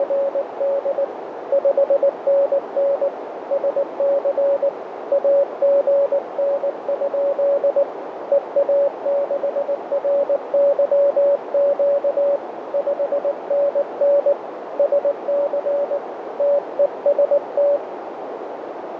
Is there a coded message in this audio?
Yes: Morse code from 0.0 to 17.8 s, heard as a keyed tone, hand-sent with a paddle, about 19 wpm, 560 Hz, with radio static and a narrow filter. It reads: … 5NN SC AGN? EA6RYQ 5NN SC TEST